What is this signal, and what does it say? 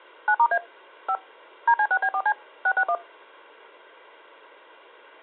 DTMF, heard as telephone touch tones, dialled by machine, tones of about 70 ms. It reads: 9*A 5 DC6B4C 661